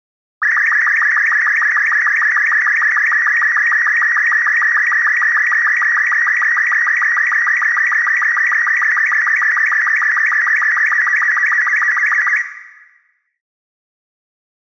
SSTV (slow-scan television), Robot 36, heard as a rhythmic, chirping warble, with room echo.